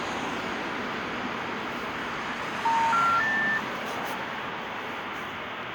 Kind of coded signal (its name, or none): telephone call progress tone